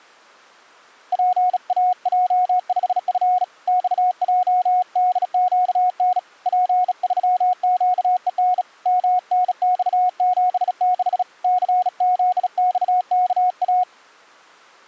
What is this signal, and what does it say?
Morse code, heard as a keyed tone, hand-sent with a bug key, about 36 wpm, 730 Hz. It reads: PAJ5F XJDQN P3QEN MNX76 CZXKA